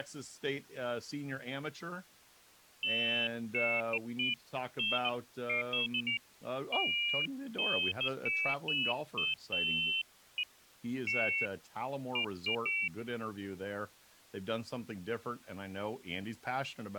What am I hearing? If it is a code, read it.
Pairs of high tones at irregular times, with speech in English. There is no code.